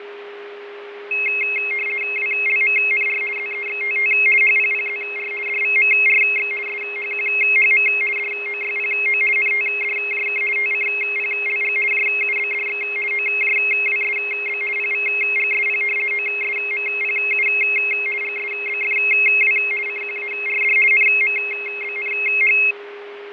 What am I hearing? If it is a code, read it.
RTTY (50 baud, 450 Hz shift), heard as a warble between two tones, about 2350 Hz centre, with radio static, fading and a steady whistle near 410 Hz. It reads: WLMNR ZEXTT HPPZR DVMRX SHQHM DOYPO NTDJK TCPLG JUBDX OJWSB PVGSP OSMPU GSBFW CQARD NMBNH